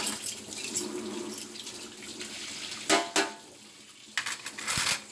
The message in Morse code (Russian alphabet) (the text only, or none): none